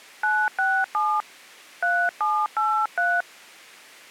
DTMF, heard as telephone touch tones, dialled by hand, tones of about 240 ms. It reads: 967 3783